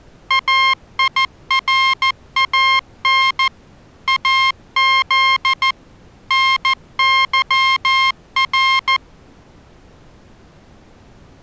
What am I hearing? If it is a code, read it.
Morse code (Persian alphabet), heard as electronic beeps, machine-sent, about 14 wpm, 1060 Hz. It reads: ایران از نظر